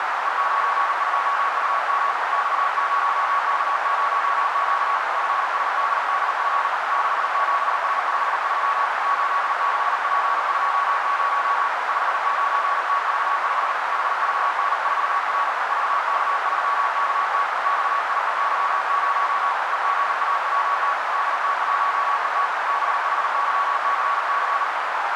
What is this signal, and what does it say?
Morse code, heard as a keyed tone, hand-sent with a paddle, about 39 wpm, 1120 Hz, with heavy radio static and a narrow filter. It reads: E92UM X0K0Q FSDDF 67S53 86P20 59TV5 HVN4R VK3KT XIEY0 EGAWT DT1ET BHYCC